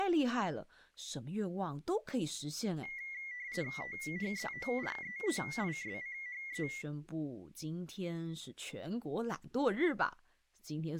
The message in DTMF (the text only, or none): none